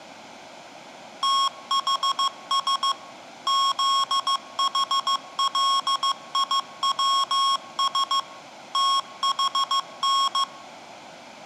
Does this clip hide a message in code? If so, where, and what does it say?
Yes: Morse code (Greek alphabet) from 1.2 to 10.5 s, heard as electronic beeps, machine-sent, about 15 wpm, 1090 Hz, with room echo. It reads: ΤΗΣ ΖΗΛΙΩΣ ΤΗΝ